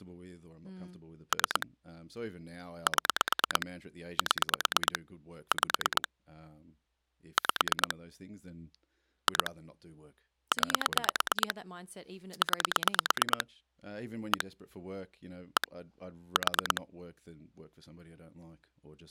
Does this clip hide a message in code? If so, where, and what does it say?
Yes: pulse dialling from 1.3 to 16.8 s, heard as clicks on a phone line, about 9 pulses a second, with speech in English. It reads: 3 7 7 5 5 2 9 9 1 1 4